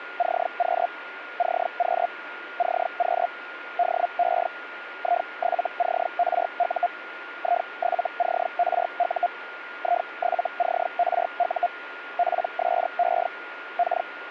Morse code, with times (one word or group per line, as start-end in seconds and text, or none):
none